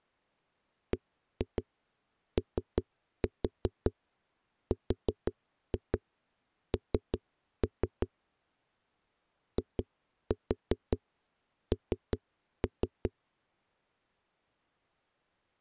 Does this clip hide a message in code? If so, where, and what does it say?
Yes: tap code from 0.9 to 13.1 s, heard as knocks on a wall, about 5 knocks a second. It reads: BORN IN